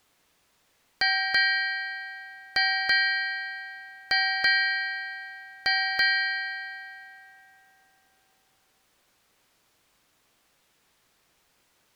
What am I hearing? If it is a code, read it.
Ship's bell, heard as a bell. 8. Eight half-hours of the watch have passed.